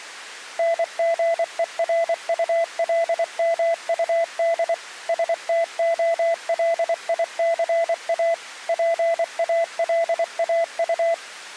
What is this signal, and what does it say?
Morse code (Russian alphabet), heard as a keyed tone, machine-sent, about 24 wpm, 670 Hz. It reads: НГЕРУЛМУД СТОЛИЦА ПАЛАУ